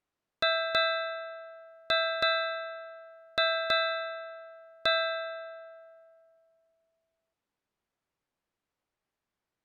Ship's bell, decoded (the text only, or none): 7